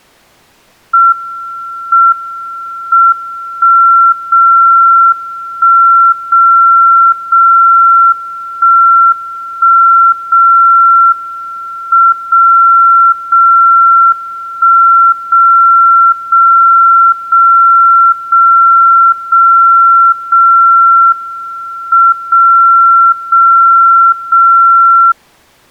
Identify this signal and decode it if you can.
Radio time signal (WWVB), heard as a tone whose level steps once a second, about 1360 Hz. The time is 20:56 UTC. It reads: M M 1 0 1 0 0 1 1 0 M 0 0 1 0 0 0 0 0 0 M 0 0 0